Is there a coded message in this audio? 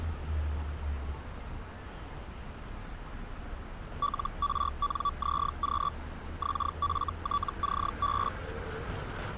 Yes: Hellschreiber (Feld-Hell, 122.5 baud) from 4.0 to 8.3 s, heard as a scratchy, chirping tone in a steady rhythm, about 1150 Hz, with street noise. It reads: LRNZQ XFTCB